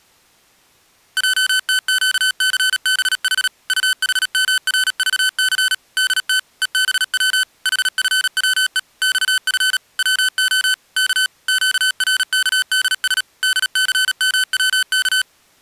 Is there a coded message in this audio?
Yes: Morse code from 1.1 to 15.3 s, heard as electronic beeps, machine-sent, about 37 wpm, 1500 Hz. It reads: JTQCBH UHMRVC DT EBW HFWE XF WO K QRKDS DCMWK